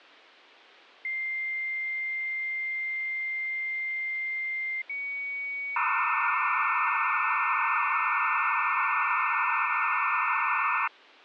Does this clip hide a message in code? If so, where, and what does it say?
Yes: dial-up modem handshake (low-speed, two carriers) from 1.0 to 10.9 s, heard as two whistles, then hiss.